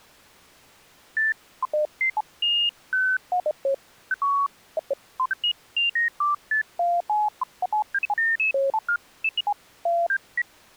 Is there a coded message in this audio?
No, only electronic bleeps of random pitch and length.